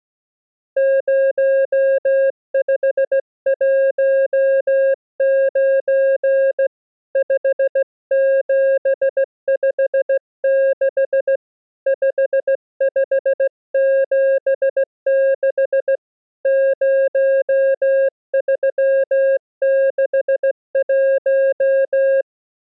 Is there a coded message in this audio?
Yes: Morse code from 0.7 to 22.3 s, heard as a keyed tone, hand-sent with a straight key, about 16 wpm, 540 Hz. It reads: 0519 5756 5576 0361